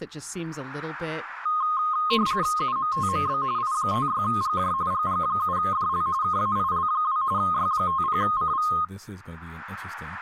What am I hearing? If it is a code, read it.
RTTY (45.45 baud, 170 Hz shift), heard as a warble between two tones, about 1160 Hz centre, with speech in English. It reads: UMTMB I56GJ GG7DL KAIL2 Y50CV